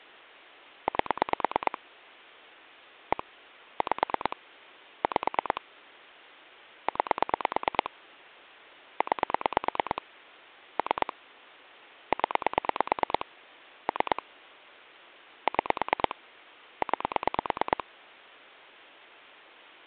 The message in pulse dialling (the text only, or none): 8 1 5 5 9 9 3 0 3 6 9